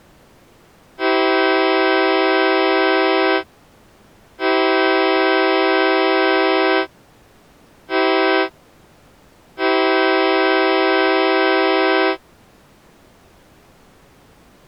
Train horn signal, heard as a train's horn. 2 long, 1 short, 1 long. On North American railways: approaching a public crossing.